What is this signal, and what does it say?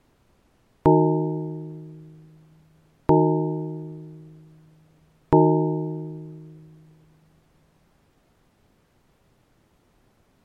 Clock strike, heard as a bell. 3. Three o'clock.